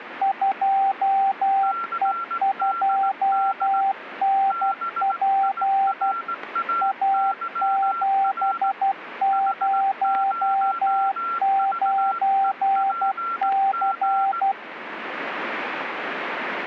Morse code, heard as two keyed tones, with radio static. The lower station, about 12 wpm, 780 Hz: 2E2NP A709C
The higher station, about 18 wpm, 1360 Hz: CDD BIRAYR H0VEPG